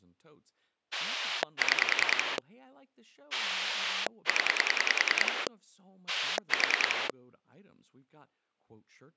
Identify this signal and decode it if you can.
Pulse dialling, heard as a rotary dial, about 10 pulses a second, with speech in English. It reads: 6 0 4